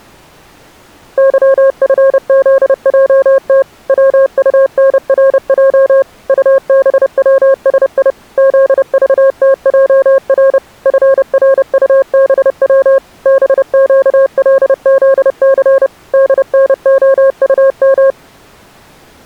Morse code, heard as a keyed tone, machine-sent, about 30 wpm, 540 Hz. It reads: YFZJT WUNRJ UBWSI ZVTJR FRUBW BQLZC DNOUM